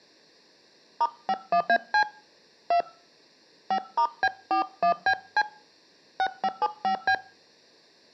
DTMF, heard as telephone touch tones, dialled by hand, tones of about 80 ms. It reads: *51AC 2 5*B41BC 6575B